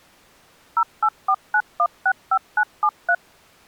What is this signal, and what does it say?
DTMF, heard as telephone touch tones, dialled by machine, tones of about 60 ms. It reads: 0849165973